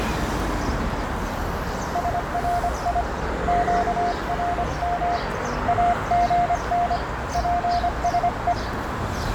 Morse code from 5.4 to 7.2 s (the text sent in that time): AGN